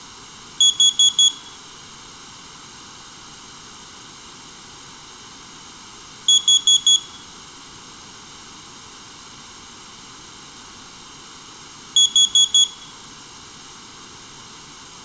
Alarm pattern, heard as an alarm's beeps, played three times, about 3350 Hz, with room echo. Temporal four. Carbon monoxide.